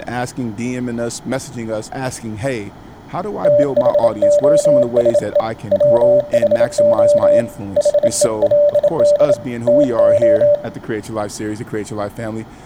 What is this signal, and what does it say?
Morse code, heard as a keyed tone, hand-sent with a bug key, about 27 wpm, 590 Hz, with speech in English. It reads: THOSE WHO HELD TO